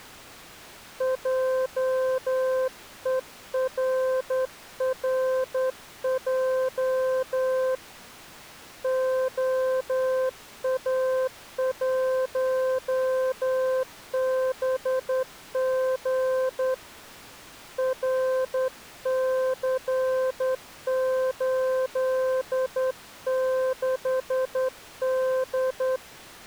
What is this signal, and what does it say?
Morse code, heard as a keyed tone, hand-sent with a straight key, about 10 wpm, 520 Hz. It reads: JERRJ OA1BG RC86D